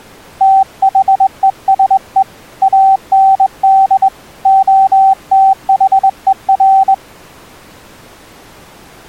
Morse code, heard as a keyed tone, hand-sent with a straight key, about 21 wpm, 770 Hz. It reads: THESE AND OTHER